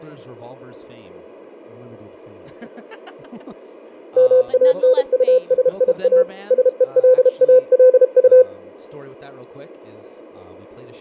Morse code, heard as a keyed tone, hand-sent with a paddle, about 32 wpm, 510 Hz. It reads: MANUSIA SELALU